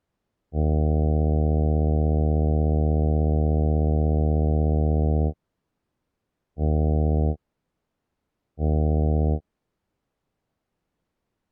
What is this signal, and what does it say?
Ship horn signal, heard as a ship's horn, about 80 Hz. 1 long, 2 short. At sea: a vessel in fog that is sailing, fishing, towing or hampered.